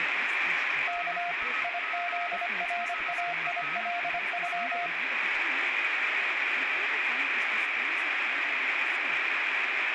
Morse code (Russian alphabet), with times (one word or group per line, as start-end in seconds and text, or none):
0.9-1.3 К
1.6-4.9 ИЗРАИЛЮ